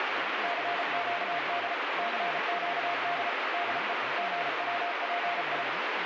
Morse code, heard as a keyed tone, machine-sent, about 34 wpm, 700 Hz, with heavy radio static and speech in Tamil. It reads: CQD CQD DE GWPI